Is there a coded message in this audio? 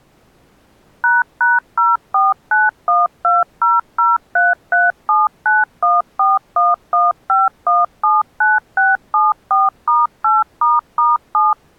Yes: DTMF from 1.0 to 11.5 s, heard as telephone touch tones, dialled by machine, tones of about 180 ms. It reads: ##0491200337914115179674*8**7